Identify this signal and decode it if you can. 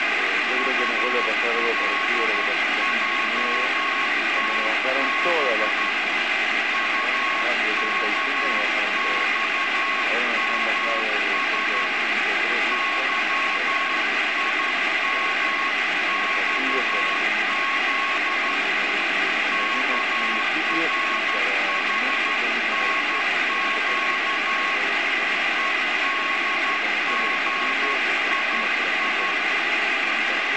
Morse code, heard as a keyed tone, hand-sent with a straight key, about 12 wpm, 1100 Hz, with heavy radio static. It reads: ULJTB UKXMS YIMXZ KRHNQ EDGII